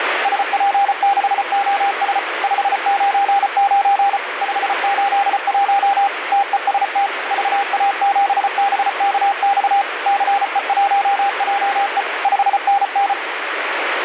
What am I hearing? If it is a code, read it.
Morse code, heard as a keyed tone, machine-sent, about 34 wpm, 800 Hz, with radio static. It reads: SP6OS 599 581 TEST VA7BKX CE1JE 5NN